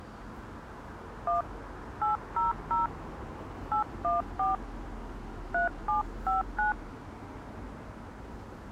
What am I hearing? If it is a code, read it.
DTMF, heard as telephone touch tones, dialled by hand, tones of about 140 ms, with street noise. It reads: 1 800 814 3759